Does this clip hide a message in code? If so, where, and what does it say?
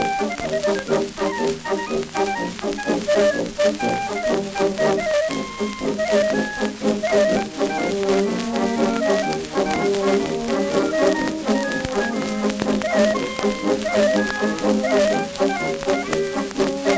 No.